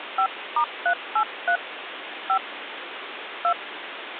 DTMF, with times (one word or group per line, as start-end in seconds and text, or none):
0.2-1.6 5*383
2.3-2.4 5
3.4-3.5 2